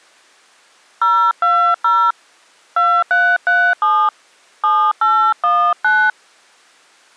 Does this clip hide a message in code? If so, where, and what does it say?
Yes: DTMF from 1.0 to 6.1 s, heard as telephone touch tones, dialled by hand, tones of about 270 ms. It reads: 020 2337 7819